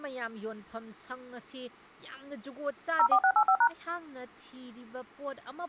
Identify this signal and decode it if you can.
DTMF, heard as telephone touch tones, dialled by machine, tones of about 70 ms, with speech in Manipuri. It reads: 04685#